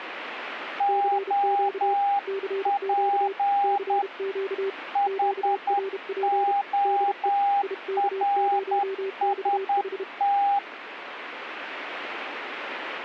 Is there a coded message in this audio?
Yes: Morse code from 0.7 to 10.6 s, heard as two keyed tones. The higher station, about 10 wpm, 800 Hz: OP HORST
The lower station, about 32 wpm, 390 Hz: CQ CQ CQ QRP DE IK0XH